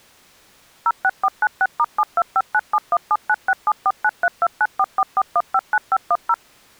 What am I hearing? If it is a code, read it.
DTMF, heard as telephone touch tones, dialled by machine, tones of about 50 ms. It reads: 06496*725971796749329444159510